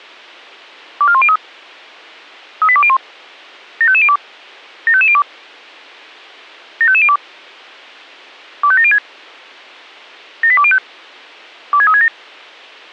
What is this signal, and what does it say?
Five-tone selective call (ZVEI), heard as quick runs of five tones, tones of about 70 ms. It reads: 24103 38201 75502 75502 75502 25706 78205 26367